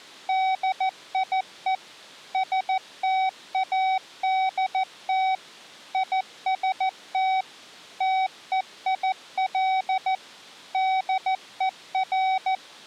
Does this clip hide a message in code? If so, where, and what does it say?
Yes: Morse code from 0.2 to 12.6 s, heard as a keyed tone, machine-sent, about 14 wpm, 760 Hz. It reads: DIE STADT IST TEIL DER